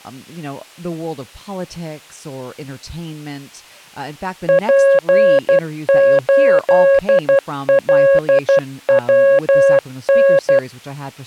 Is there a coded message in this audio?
Yes: Morse code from 4.4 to 10.6 s, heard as a keyed tone, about 12 wpm, 550 Hz, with speech in English. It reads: P8LWN